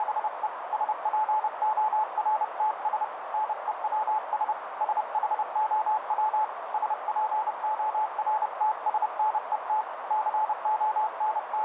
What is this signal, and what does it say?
Morse code, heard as a keyed tone, hand-sent with a paddle, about 30 wpm, 860 Hz, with radio static and a narrow filter. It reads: … SPORTS NEWS SHOW SPORTSNET …